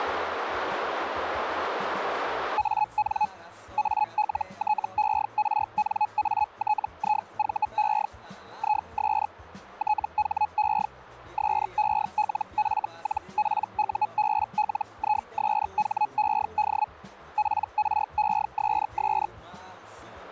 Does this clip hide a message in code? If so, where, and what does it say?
Yes: Hellschreiber (Feld-Hell, 122.5 baud) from 2.6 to 19.3 s, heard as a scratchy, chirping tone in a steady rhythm, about 850 Hz. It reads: AN ALTERNATIVE IS THE SELF-PUBLISHED PRESS